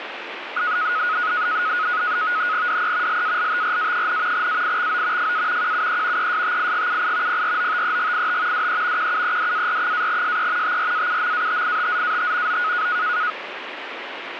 NAVTEX (SITOR-B), 100 baud, 170 Hz shift, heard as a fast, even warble, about 1360 Hz centre, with radio static. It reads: DE LALTRA, AIXO FA QUE ESTIGUI PROTEGIT DE QUEDAR-SE TRAUMATITZAT O